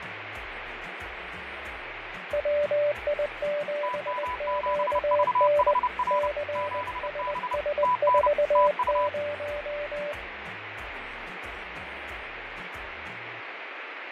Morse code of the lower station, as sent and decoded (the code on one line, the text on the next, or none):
.-- .. --... --.- -. / -.-. ... ... ....- -----
WI7QN CSS40